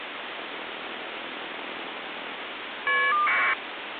Caller ID data burst, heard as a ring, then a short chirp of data, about 1200 baud, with phone line noise.